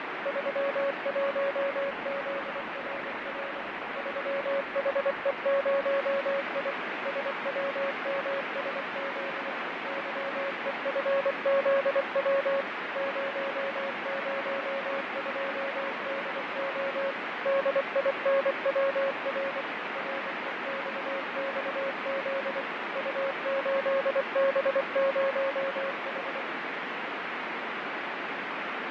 Morse code, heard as a keyed tone, machine-sent, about 24 wpm, 550 Hz, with heavy radio static and fading. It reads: 31ZRR 3HE0I SWMSZ YEFZW 002DO DINWR REXXZ U8B0H